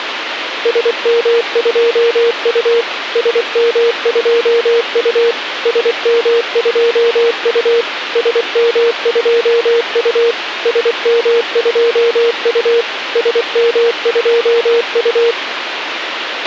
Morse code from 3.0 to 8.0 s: SM2U SM2U

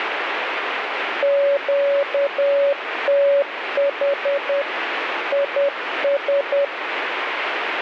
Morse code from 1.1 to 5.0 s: QTH

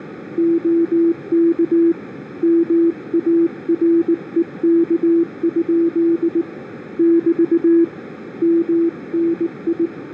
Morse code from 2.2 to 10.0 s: MAREK? <BT> MNI

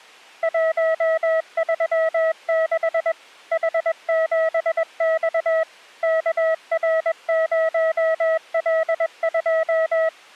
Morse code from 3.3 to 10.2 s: H7X KR0L2

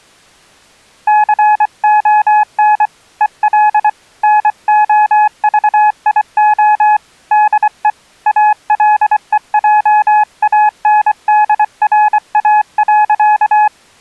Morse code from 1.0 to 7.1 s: CON EL NOVIO

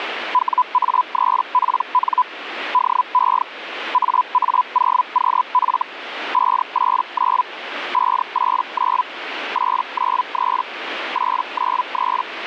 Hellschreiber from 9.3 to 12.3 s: 893 893

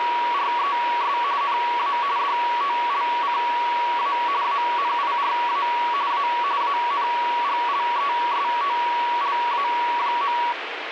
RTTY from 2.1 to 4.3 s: DOLCA

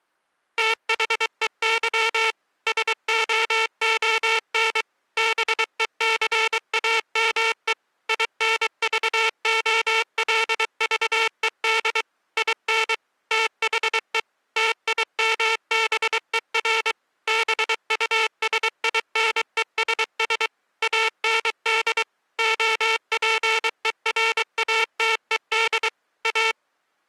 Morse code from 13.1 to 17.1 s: THE TIMBER

